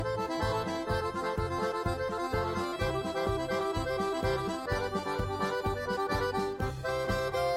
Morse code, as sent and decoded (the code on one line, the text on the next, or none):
none